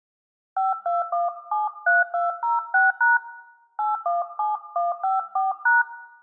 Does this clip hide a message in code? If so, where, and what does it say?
Yes: DTMF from 0.6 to 5.8 s, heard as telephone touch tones, dialled by hand, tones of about 160 ms, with room echo. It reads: 52173206# 817154#